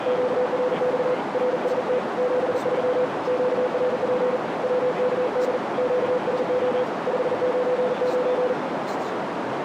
Morse code, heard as a keyed tone, hand-sent with a paddle, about 40 wpm, 500 Hz, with heavy radio static, a narrow filter and speech in English. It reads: QRX RST 73 QRP WKD QSO 599